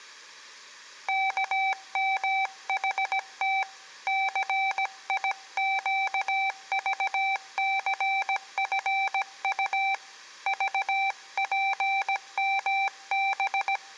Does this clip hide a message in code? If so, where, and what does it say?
Yes: Morse code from 1.0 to 13.8 s, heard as a keyed tone, hand-sent with a paddle, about 17 wpm, 780 Hz. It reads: KMHT CIQVCFU VPMB